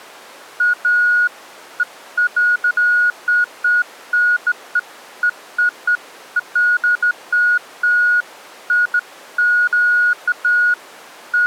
Beeps of irregular length. There is no code.